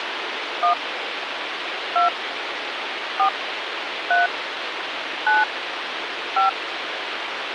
DTMF, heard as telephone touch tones, dialled by hand, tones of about 130 ms, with radio hiss. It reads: 1 2 4 3 9 5